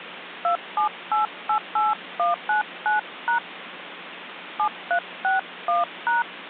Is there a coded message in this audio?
Yes: DTMF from 0.4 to 6.2 s, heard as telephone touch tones, dialled by hand, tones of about 130 ms, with phone line noise. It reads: 27888199# 7361#